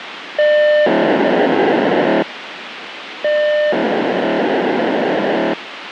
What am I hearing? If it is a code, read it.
POCSAG pager data (1200 baud), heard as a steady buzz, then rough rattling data, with radio hiss.